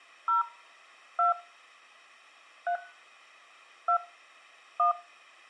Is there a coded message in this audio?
Yes: DTMF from 0.3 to 4.9 s, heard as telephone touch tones, dialled by hand, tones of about 120 ms, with room echo. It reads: 0 2 3 2 1